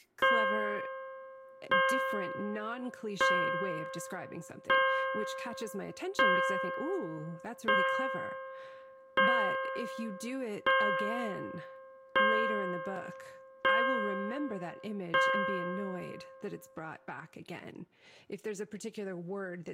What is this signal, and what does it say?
Clock strike, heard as a bell, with speech in English. 11. Eleven o'clock.